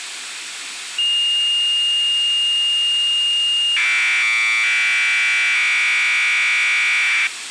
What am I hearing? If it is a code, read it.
Commodore tape loading (standard loader), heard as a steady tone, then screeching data, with tape hiss.